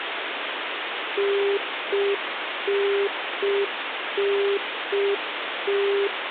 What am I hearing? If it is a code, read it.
Telephone call progress tone (UK plan), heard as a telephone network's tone, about 400 Hz, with phone line noise. Congestion tone.